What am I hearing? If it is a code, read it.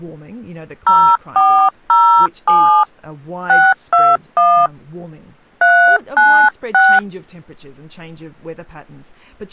DTMF, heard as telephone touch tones, dialled by hand, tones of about 300 ms, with speech in English. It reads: 0407 621 396